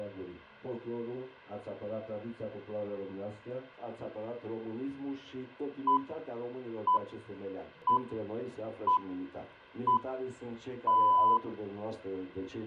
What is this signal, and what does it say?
Radio time signal (six pips, as the Greenwich Time Signal), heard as pips.